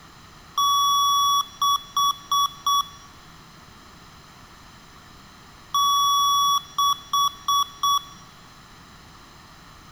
Beep code, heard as beeps from a small speaker, played twice, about 1130 Hz, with room echo. 1 long, 4 short.